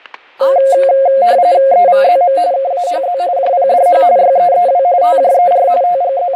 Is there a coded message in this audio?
Yes: RTTY (45.45 baud, 170 Hz shift) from 0.4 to 6.4 s, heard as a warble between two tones, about 620 Hz centre, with fading, static crashes and speech in Kashmiri. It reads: EVZM KAHZ JPDH YEEW TJER …